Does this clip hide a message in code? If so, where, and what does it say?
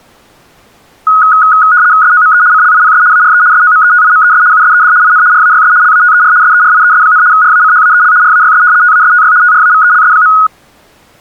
Yes: RTTY (75 baud, 170 Hz shift) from 1.1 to 10.5 s, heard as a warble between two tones, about 1360 Hz centre. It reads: SOME CLIPS ARE SOMETIMES USED IN RAYS LATER SERIES, RACHAEL RAYS TASTY TRAVELS.